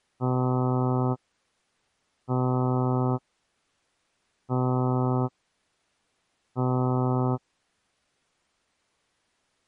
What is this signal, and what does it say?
Ship horn signal, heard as a ship's horn, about 130 Hz. 4 short. At sea: a pilot vessel's identity signal in fog.